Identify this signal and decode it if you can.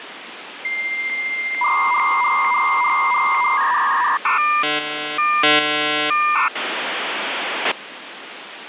Dial-up modem handshake (V.34 or later), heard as a whistle, warbles, then hiss, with phone line noise.